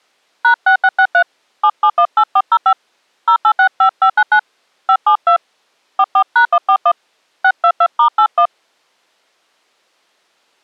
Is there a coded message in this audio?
Yes: DTMF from 0.4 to 8.5 s, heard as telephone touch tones, dialled by hand, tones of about 70 ms. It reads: #6663 7718405 0865599 572 44#141 622*81